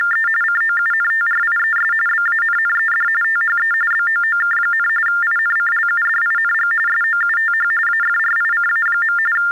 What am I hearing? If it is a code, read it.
TTY/TDD text telephone tones (45.45 baud Baudot), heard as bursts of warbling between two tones, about 400 Hz shift, 1600 Hz centre. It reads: … COUNTRIES BANNED THE BOOK, INCLUDING SOUTH AFRICA. …